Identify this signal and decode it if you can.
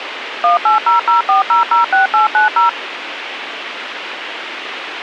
DTMF, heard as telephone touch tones, dialled by machine, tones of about 130 ms, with radio hiss. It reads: 18004006890